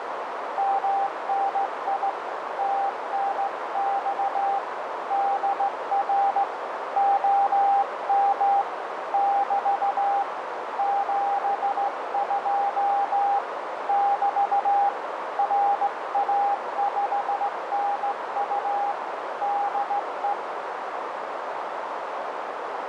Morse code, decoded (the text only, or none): MNI TNX DR OM <BT> 72 <BT> RA5NU DE